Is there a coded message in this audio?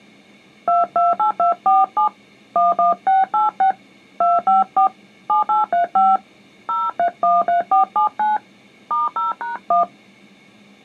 Yes: DTMF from 0.7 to 9.8 s, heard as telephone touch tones, dialled by hand, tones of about 150 ms. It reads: 228247 11686 254 7835 0313479 *0#1